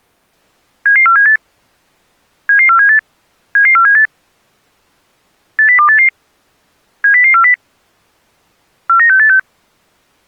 Five-tone selective call (CCIR), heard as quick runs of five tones, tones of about 100 ms. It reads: 77478 77478 77478 80288 70040 49686